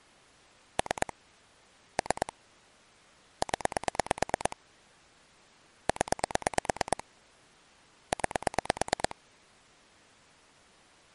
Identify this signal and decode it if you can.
Pulse dialling, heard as clicks on a phone line, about 9 pulses a second. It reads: 3 3 0 0 9